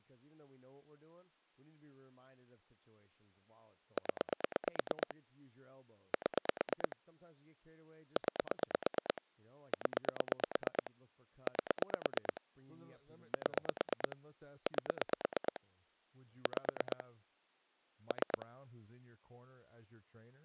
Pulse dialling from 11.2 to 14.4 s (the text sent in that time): 8 7